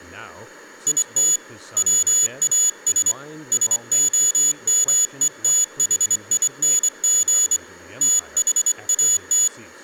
Morse code, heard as a high beeper, hand-sent with a straight key, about 24 wpm, 3450 Hz, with speech in English. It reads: IT WAS SOMETHING THAT